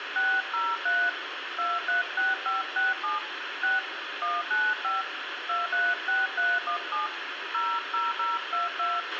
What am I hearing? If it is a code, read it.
DTMF, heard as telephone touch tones, dialled by hand, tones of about 170 ms, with radio hiss, a squelch burst at the end and room echo. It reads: 603 236567 6 195 236317 00022